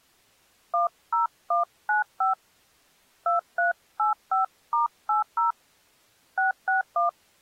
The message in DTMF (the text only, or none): 10195 2385*80 661